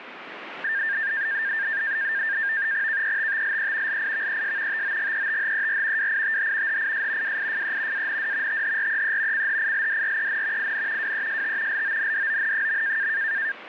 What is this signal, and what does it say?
NAVTEX (SITOR-B), 100 baud, 170 Hz shift, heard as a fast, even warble, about 1700 Hz centre, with radio static. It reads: KETTLE LIVES TOGETHER WITH HIS WIFE AND THREE CHILDREN IN WEST LONDON.